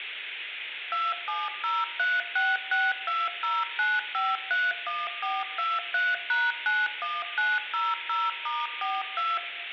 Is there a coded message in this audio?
Yes: DTMF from 0.9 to 9.4 s, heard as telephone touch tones, dialled by machine, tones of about 200 ms, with phone line noise. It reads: 270366209531423#91900*42